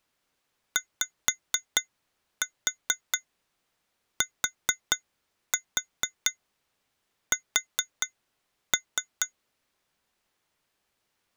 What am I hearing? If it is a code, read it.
Tap code, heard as taps on glass, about 4 knocks a second. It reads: YTS